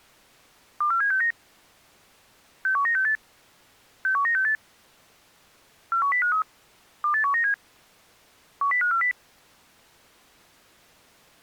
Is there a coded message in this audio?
Yes: five-tone selective call (CCIR) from 0.8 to 9.1 s, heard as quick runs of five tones, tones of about 100 ms. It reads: 24769 61968 61968 41053 28197 10540